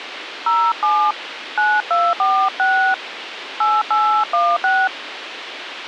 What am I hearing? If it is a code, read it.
DTMF, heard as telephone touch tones, dialled by hand, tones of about 270 ms, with radio hiss. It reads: 07 9246 8816